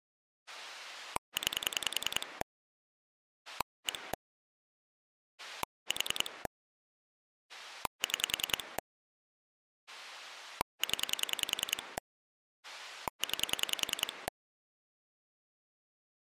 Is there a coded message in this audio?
Yes: pulse dialling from 0.5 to 14.3 s, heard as a rotary dial, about 10 pulses a second. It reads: 9 1 4 6 0 9